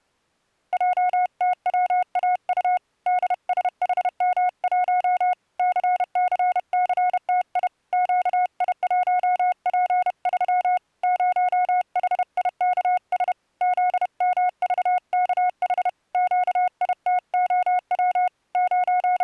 Morse code, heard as a keyed tone, hand-sent with a paddle, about 31 wpm, 730 Hz. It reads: JTWAU DSHM1 CCCTI QI1P3 0HIKS ZMVKH QITOW …